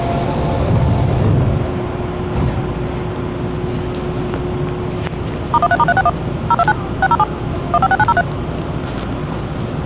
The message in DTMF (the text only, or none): *13*361 029 607 156903